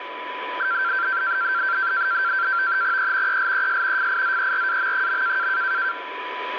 NAVTEX (SITOR-B), 100 baud, 170 Hz shift, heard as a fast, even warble, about 1460 Hz centre, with radio static and a steady whistle near 990 Hz. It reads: E ELES FIZERAM.